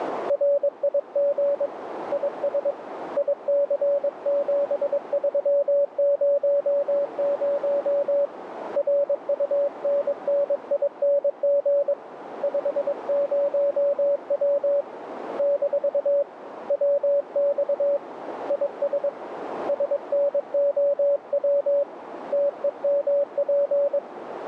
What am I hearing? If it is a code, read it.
Morse code, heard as a keyed tone, hand-sent with a paddle, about 22 wpm, 570 Hz, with radio static and a narrow filter. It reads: RIG IS IC7300 RUNNING 50W - WX IS SNOW TEMP